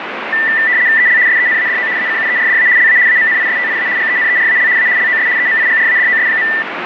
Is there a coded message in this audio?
Yes: RTTY (75 baud, 170 Hz shift) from 0.3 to 6.6 s, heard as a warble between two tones, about 1900 Hz centre, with radio static. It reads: EL SENADO ACUERDA LA AMNISTIA GENERAL A LOS EMIGRADOS.